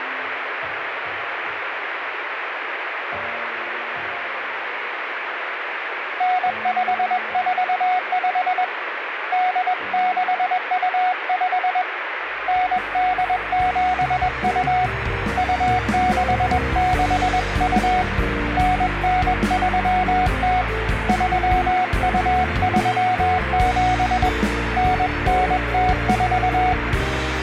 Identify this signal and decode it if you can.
Morse code (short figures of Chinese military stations), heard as a keyed tone, hand-sent with a paddle, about 21 wpm, 740 Hz, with radio static. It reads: 9545 8625 9872 2662 9930 3237 9904